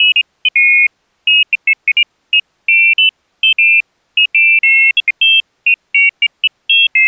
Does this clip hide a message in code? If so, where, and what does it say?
No, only pairs of high tones at irregular times.